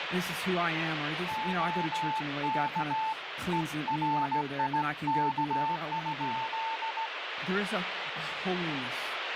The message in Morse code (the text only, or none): OK ERIK?